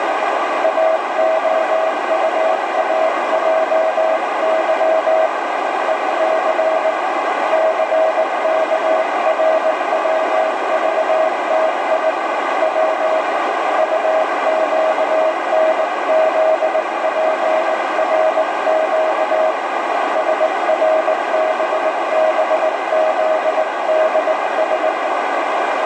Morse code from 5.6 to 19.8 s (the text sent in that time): EC CKRWVTI W UQNZPRQ